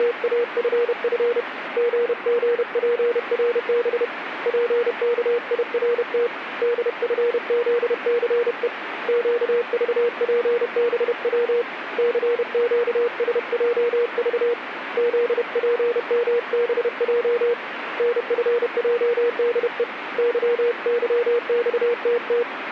Morse code, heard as a keyed tone, hand-sent with a paddle, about 31 wpm, 480 Hz, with radio static. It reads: … GGPRB PKIRT DFZCE QVPBW CQSJV ZPMBJ NFJDE YYXTT